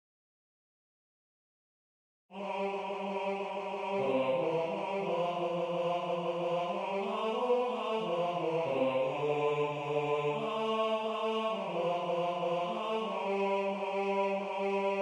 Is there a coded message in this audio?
No.